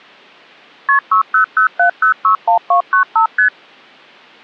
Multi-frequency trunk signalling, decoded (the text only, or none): KP 6007061295 ST